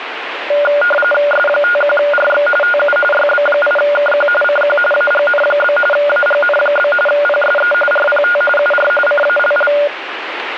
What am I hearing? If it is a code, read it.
RTTY (45.45 baud, 850 Hz shift), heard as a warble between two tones, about 1010 Hz centre, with radio static. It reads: S51RX TU YB8KQ CQ AGN? AGN? PSE RPT UR CALL